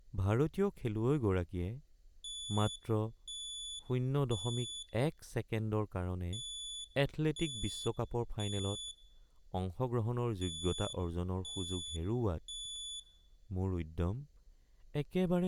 Alarm pattern, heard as an alarm's beeps, played three times, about 3450 Hz, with room echo and speech in Assamese. Temporal three. Smoke or fire, evacuate.